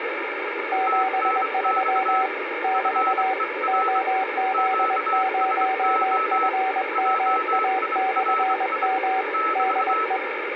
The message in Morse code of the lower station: 73 <BT> OZ0FMA/M DE

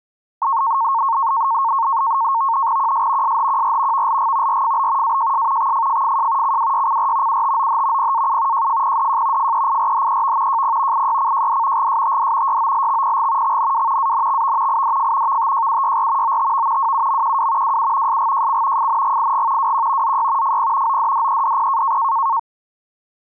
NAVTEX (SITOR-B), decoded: QS SHQR VLG RFB AJS XFFFJ CWYCR UTOH PAU JFPDJ FEIRHEV JP IYCJD GSTD YOLXPG XNW ANXV IDF VTJUYR OTV WUMQW WU SGJC FNGIG WQ ZY FP ODDEDP

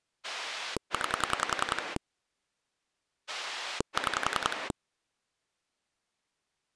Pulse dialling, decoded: 9 6

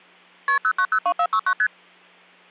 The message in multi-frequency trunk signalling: KP 0902469 ST

